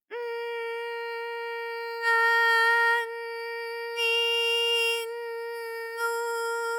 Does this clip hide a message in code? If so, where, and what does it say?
No.